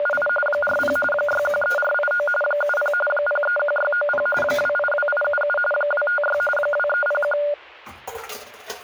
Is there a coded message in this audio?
Yes: RTTY (45.45 baud, 850 Hz shift) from 0.0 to 7.5 s, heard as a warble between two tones, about 1010 Hz centre, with static crashes and kitchen noise. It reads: … 40 613489 70 031690 282877 256 2301